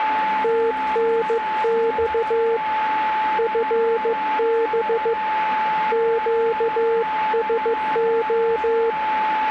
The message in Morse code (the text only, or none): TNX FB QSO